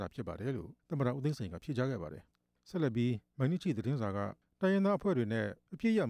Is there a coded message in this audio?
No.